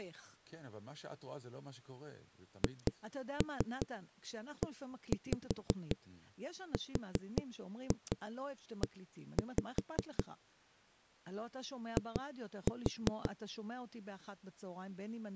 Tap code, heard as knocks on a wall, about 5 knocks a second, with speech in Hebrew. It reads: HERE I